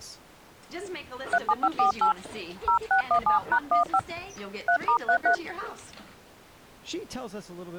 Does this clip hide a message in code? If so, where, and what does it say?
Yes: DTMF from 1.3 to 5.3 s, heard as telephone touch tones, dialled by hand, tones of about 90 ms. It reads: 37548 0617#15 3*33